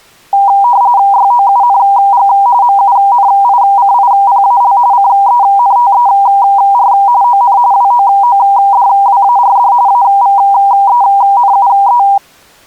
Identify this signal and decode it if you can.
RTTY (45.45 baud, 170 Hz shift), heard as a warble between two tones, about 880 Hz centre. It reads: YOUNG MUNICIPAL CENTER ON WOODWARD AVENUE